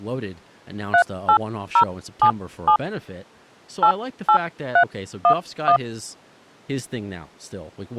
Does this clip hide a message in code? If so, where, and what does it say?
Yes: DTMF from 0.9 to 5.8 s, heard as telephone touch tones, dialled by hand, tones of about 80 ms, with speech in English. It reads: 38077 88311